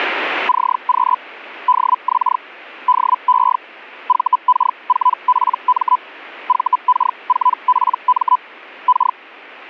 Hellschreiber (Feld-Hell, 122.5 baud), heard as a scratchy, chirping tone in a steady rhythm, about 1000 Hz. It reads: CQ DX DE VK4PM VK4PM K